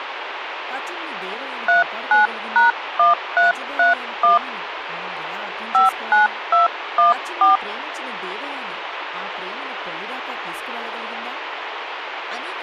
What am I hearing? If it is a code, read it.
DTMF, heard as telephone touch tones, dialled by hand, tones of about 140 ms, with radio hiss and speech in English. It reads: 39#1331 59214